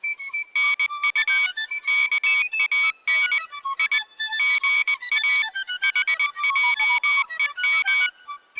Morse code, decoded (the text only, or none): NU KAN I GA HJEM